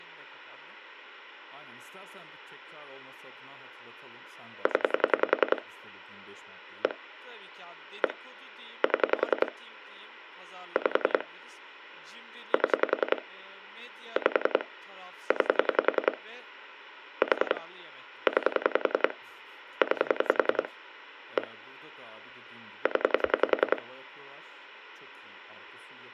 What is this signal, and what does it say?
Pulse dialling, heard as clicks on a phone line, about 10 pulses a second, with speech in Turkish. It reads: 0 1 1 7 5 7 5 9 4 9 9 1 0